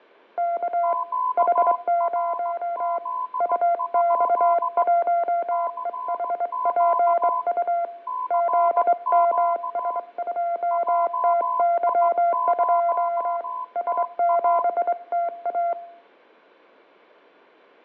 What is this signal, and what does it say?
Morse code, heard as two keyed tones, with fading and room echo. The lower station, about 23 wpm, 690 Hz: K H0 UX1EHPU ZMS2TY2 S7TA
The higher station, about 16 wpm, 1010 Hz: QRZ? CQ CQ JI0TA